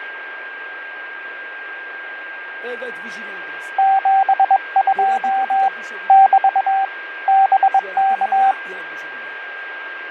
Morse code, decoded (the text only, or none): 72 <BT> BK